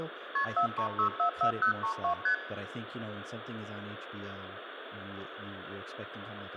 Multi-frequency trunk signalling (R1, as on North American trunks), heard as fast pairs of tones, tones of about 100 ms, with phone line noise, room echo and speech in English. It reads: KP 43644032 ST